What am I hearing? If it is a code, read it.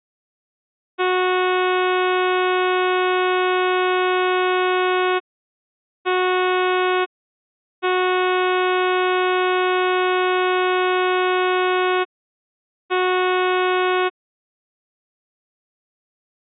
Ship horn signal, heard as a ship's horn, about 370 Hz. 1 long, 1 short, 1 long, 1 short. At sea: I agree to be overtaken.